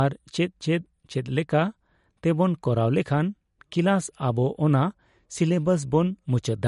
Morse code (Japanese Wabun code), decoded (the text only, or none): none